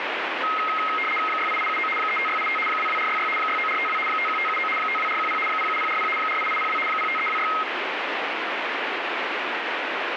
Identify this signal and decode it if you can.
RTTY (75 baud, 850 Hz shift), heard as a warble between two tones, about 1700 Hz centre, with radio static. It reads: 68879 35685 22466 69452 51579 52410 07040 48802 05326